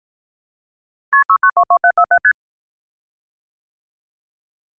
Multi-frequency trunk signalling (R1, as on North American trunks), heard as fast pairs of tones, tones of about 70 ms. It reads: KP 6922747 ST